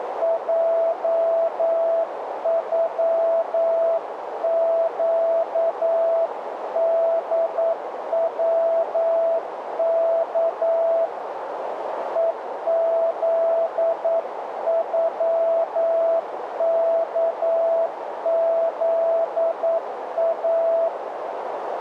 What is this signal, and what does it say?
Morse code (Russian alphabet), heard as a keyed tone, hand-sent with a paddle, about 9 wpm, 660 Hz, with radio static and a narrow filter. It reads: ЙЮЩДВК ЕЗЮКЗА